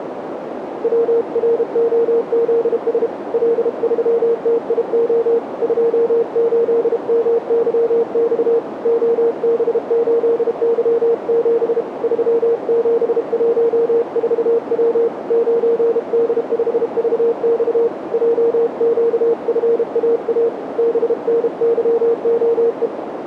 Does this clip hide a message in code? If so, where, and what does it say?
Yes: Morse code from 0.8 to 22.9 s, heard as a keyed tone, hand-sent with a paddle, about 32 wpm, 460 Hz, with radio static and a narrow filter. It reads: WROZS L3TIO 28MYX OB8Y7 3714W 9D5VX JQFAA BNYOE